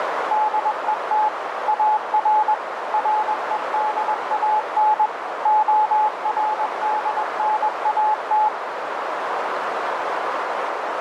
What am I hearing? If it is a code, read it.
Morse code, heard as a keyed tone, machine-sent, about 21 wpm, 860 Hz, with heavy radio static and a narrow filter. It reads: DET AR REDAN ORDNAT